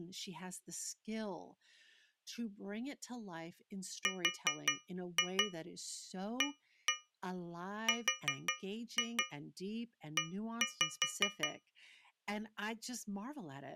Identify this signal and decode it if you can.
Tap code, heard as taps on a metal pipe, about 5 knocks a second, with speech in English. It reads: RARE